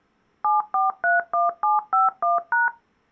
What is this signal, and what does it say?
DTMF, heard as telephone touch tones, dialled by machine, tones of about 160 ms. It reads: 7431751#